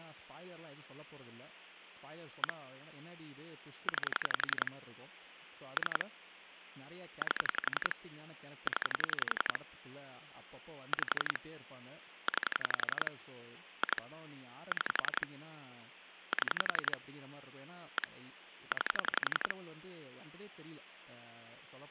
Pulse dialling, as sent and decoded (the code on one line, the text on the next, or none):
1 / 9 / 3 / 8 / 10 / 5 / 9 / 2 / 6 / 7 / 1 / 9
1 9 3 8 0 5 9 2 6 7 1 9